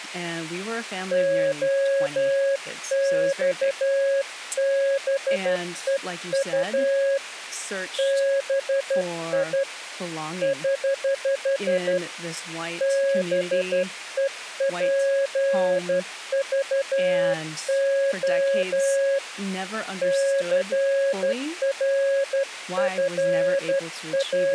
Morse code, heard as a keyed tone, hand-sent with a straight key, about 12 wpm, 550 Hz, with speech in English. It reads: OXBEU BI <HH> BEPVO …